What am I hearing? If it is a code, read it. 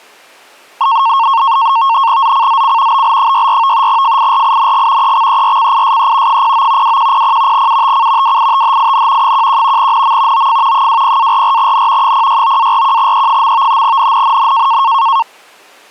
NAVTEX (SITOR-B), 100 baud, 170 Hz shift, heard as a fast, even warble, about 1000 Hz centre. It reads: ZCZC BL64 FIRING EXERCISE 09 2100 UTC WITHIN 11 NM OF 20-44N 069-41E. NNNN